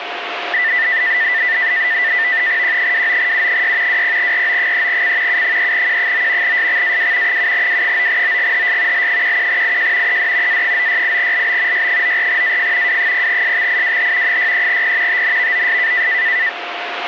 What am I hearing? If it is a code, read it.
NAVTEX (SITOR-B), 100 baud, 170 Hz shift, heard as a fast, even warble, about 1900 Hz centre, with radio static and a steady whistle near 700 Hz. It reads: Q29U6 20RO3C U3Q9 SXAW 7W9OGHS L11IJ ED A968LB Y94AF W0SXIWH 63P TNVOS